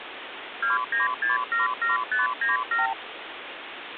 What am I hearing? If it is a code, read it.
Multi-frequency trunk signalling (R2, with the far end's replies), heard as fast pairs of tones, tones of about 150 ms, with phone line noise. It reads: 29677597